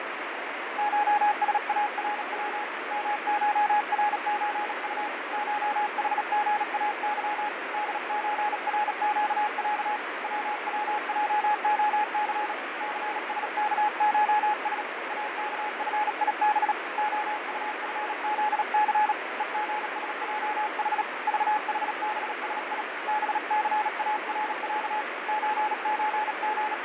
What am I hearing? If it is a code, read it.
Morse code (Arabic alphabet), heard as a keyed tone, hand-sent with a paddle, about 37 wpm, 840 Hz, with heavy radio static and fading. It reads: شسارو مشرزط شحغاظ دزرقع ووجخث ثسكشس اكفيب خطفذث ءغسجح ضحبسي بثارع …